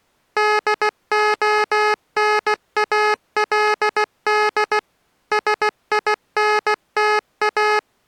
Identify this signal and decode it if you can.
Morse code, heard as electronic beeps, machine-sent, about 16 wpm, 420 Hz. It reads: DONALD SINTA